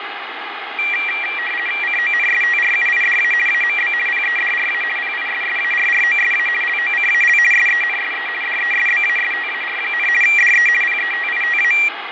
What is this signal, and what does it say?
RTTY (50 baud, 450 Hz shift), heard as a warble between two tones, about 2150 Hz centre, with radio static, fading and room echo. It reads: CONSTRUIDA AMB PEDRA PISSARROSA LOCAL SENSE DESBASTAR, DE PETITA